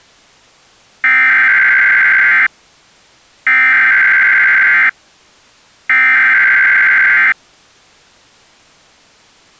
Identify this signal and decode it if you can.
Emergency Alert System (SAME) tones (header bursts), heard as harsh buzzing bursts, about 520.83 baud.